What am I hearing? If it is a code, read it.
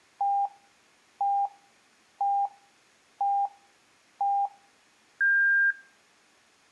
Radio time signal (five pips and a higher one, as on Chinese radio), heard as pips.